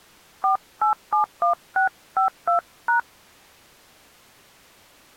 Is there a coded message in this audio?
Yes: DTMF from 0.4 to 3.0 s, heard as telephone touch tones, dialled by hand, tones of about 120 ms. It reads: 4871652#